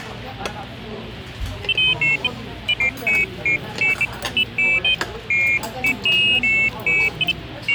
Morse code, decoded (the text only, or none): none